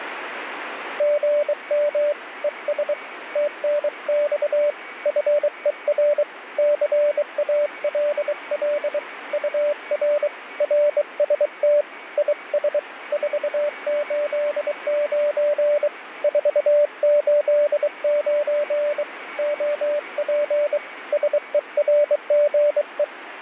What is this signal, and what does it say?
Morse code, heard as a keyed tone, hand-sent with a bug key, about 23 wpm, 590 Hz, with radio static and a weaker station near 2250 Hz. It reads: GM ES TNX FER CALL UR RST IS 489 489 OP SERGE